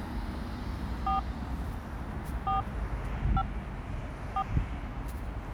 DTMF, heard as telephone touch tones, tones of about 100 ms, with the noise of a residential street. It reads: 4 4 5 4